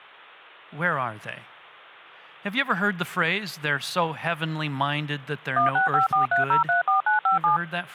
DTMF, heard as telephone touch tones, dialled by machine, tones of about 130 ms, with speech in English. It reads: 16543034957